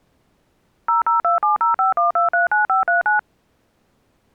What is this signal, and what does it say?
DTMF, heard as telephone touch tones, dialled by machine, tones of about 140 ms. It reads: 0027051239539